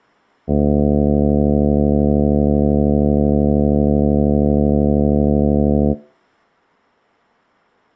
Ship horn signal, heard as a ship's horn, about 70 Hz. 1 long. At sea: a vessel nearing a blind bend, or under power and making way in fog.